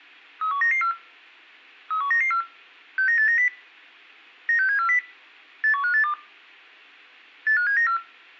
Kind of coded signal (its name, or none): five-tone selective call